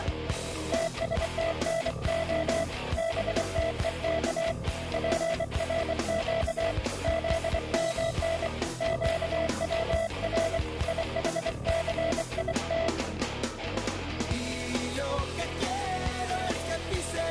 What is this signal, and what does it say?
Morse code (Hebrew alphabet), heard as a keyed tone, hand-sent with a bug key, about 24 wpm, 660 Hz. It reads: תשתנה בתוך פרק זמן קצר יחסית